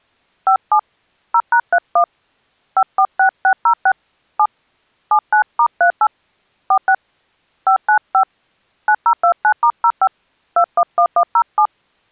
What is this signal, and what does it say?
DTMF, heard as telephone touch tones, dialled by hand, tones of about 80 ms. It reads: 57 0#31 546606 7 79*38 46 595 9029*05 211107